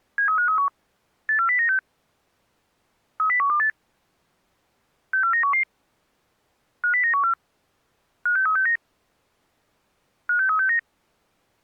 Five-tone selective call (CCIR), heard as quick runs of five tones, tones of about 100 ms. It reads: 73531 84096 30128 64911 50914 56369 56369